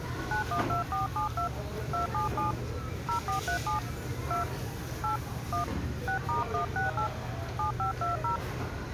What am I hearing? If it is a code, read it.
DTMF, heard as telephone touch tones, dialled by hand, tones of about 120 ms, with the noise of a restaurant. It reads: 912472 277 0437 2 8 1 6*168 7520